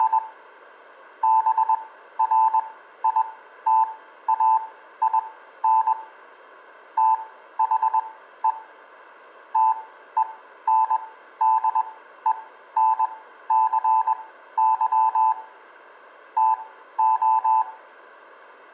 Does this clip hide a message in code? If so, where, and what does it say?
Yes: Morse code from 0.0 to 17.7 s, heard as a keyed tone, machine-sent, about 21 wpm, spaced as for 13 wpm, 880 Hz, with room echo. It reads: … BRITAIN THE TENDENCY TO